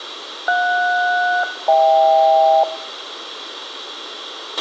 Aircraft SELCAL, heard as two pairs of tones, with a squelch burst at the end and room echo. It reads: JS-HK